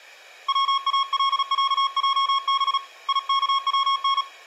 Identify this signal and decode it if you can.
Morse code (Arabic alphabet), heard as a keyed tone, hand-sent with a paddle, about 36 wpm, 1090 Hz, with room echo. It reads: والعجب يكون